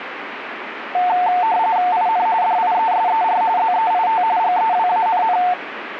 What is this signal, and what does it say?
RTTY (45.45 baud, 170 Hz shift), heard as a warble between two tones, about 810 Hz centre, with radio static. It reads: IN DIESER ZEIT GEWANN